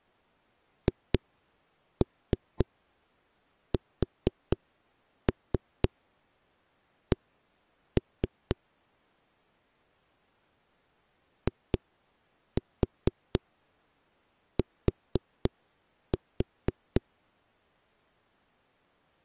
Tap code, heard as knocks on a wall, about 4 knocks a second. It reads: HSC IT